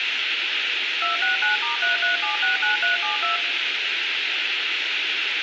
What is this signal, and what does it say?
DTMF, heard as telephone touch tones, dialled by machine, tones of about 130 ms, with phone line noise. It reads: 269*33769372